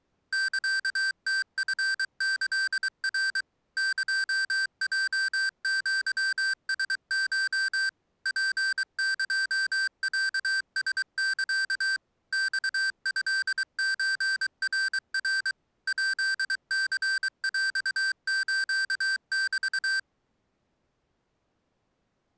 Morse code (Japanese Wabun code), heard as electronic beeps, machine-sent, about 23 wpm, 1550 Hz. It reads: サムチキナ エヲアラコ ツエロラサ マトソナナ ヱニヰスメ